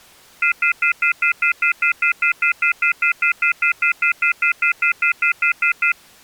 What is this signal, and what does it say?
Telephone call progress tone (North American plan), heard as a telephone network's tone, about 1400, 2050, 2450, 2600 Hz, 0.1 s on and 0.1 s off. Off-hook warning tone.